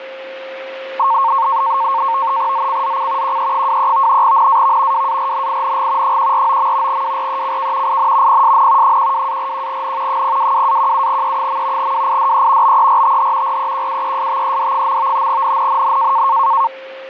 NAVTEX (SITOR-B), 100 baud, 170 Hz shift, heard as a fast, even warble, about 1000 Hz centre, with radio static and a steady whistle near 530 Hz. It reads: ZCZC QE23 NAV WARNING 149. WRECK IN PSN 12-41N 022-17E. WIDE BERTH REQUESTED. NNNN